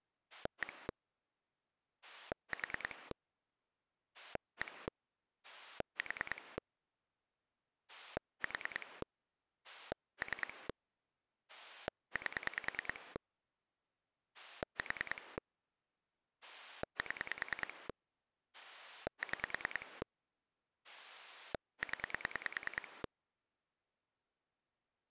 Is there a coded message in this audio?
Yes: pulse dialling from 0.3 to 23.1 s, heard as a rotary dial, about 10 pulses a second. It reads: 1 4 1 4 4 3 8 4 7 6 0